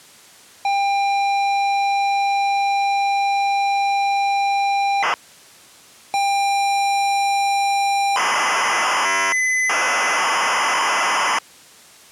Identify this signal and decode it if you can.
ZX Spectrum tape loading, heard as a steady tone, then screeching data.